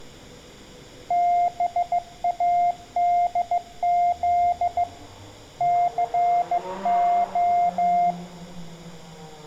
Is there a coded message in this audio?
Yes: Morse code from 1.0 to 8.2 s, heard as a keyed tone, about 15 wpm, 700 Hz, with room echo and street noise. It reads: BADZ CO